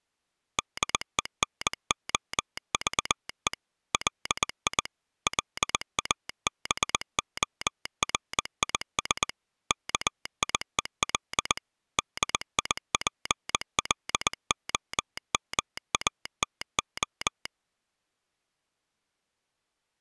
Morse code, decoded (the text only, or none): DENOVE LI LABORIS KIEL DIPLOMATO